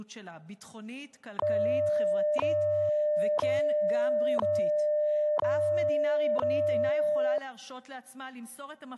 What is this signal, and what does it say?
Radio time signal (WWV, Colorado), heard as ticks, one a second.